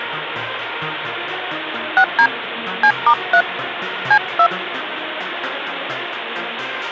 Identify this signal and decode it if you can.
DTMF, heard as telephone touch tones, dialled by hand, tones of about 70 ms, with phone line noise. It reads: 6D C*3 C2